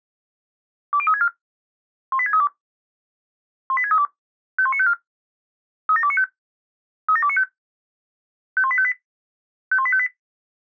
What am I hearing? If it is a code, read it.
Five-tone selective call (ZVEI), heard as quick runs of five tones, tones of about 70 ms. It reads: 20364 18632 18632 51954 37295 37295 51858 51858